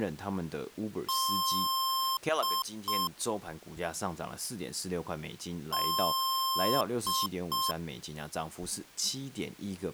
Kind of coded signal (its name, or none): beep code